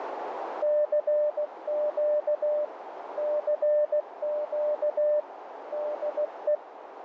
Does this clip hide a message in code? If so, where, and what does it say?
Yes: Morse code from 0.6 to 6.6 s, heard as a keyed tone, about 16 wpm, 600 Hz, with radio static and a narrow filter. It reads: CQ CQ DE